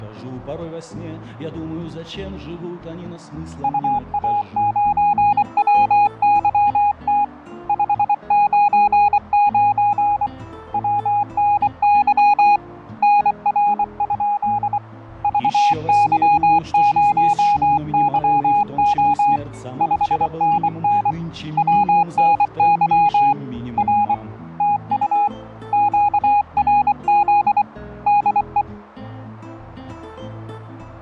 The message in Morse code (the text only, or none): UA9WYT 599 WNY NR? VY0YO 5NN WNY R TU QRZ DE